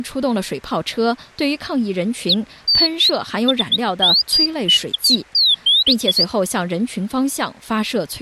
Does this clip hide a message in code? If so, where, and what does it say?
No, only bird-like chirps.